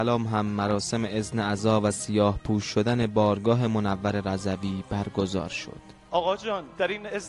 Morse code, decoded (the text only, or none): none